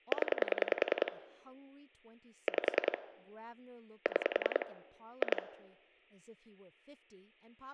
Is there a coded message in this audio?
Yes: pulse dialling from 0.1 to 5.4 s, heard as clicks on a phone line, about 10 pulses a second, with speech in English. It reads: 0 5 6 2